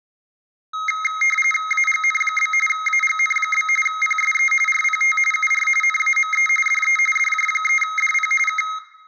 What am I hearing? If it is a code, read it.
RTTY (45.45 baud, 850 Hz shift), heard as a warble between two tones, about 1700 Hz centre, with room echo. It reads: AGN? AGN? PSE RPT UR NAME DE DJ3DP K